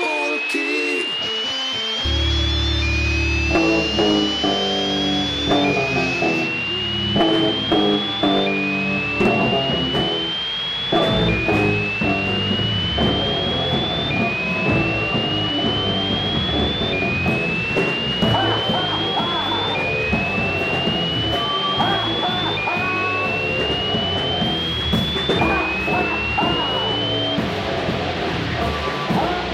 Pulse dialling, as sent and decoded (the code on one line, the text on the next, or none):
none